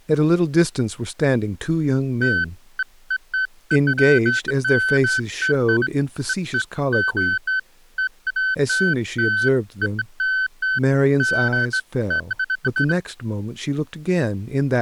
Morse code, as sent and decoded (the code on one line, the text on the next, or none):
none